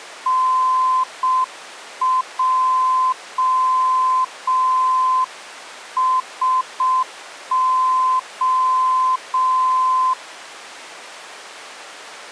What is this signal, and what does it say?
Morse code (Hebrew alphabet), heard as a keyed tone, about 6 wpm, 1030 Hz. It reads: נעשה